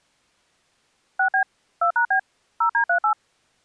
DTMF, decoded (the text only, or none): 6B 2#B 0D38